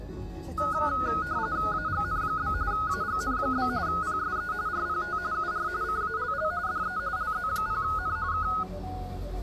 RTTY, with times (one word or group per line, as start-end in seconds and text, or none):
1.7-2.5 AGN?
2.7-3.7 AGN?
3.9-4.5 PSE
4.7-5.2 RPT
5.3-5.7 UR
5.8-6.5 CALL
6.7-7.0 DE
7.2-8.2 LZ0N
8.3-8.5 K